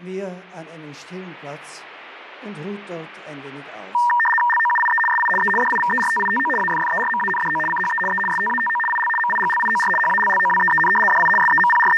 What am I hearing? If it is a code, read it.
RTTY (75 baud, 850 Hz shift), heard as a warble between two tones, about 1390 Hz centre. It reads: LOUIE SI E DIVERTITO AFFERMANDO CHE E STATO IL MIGLIOR HALLOWEEN DI …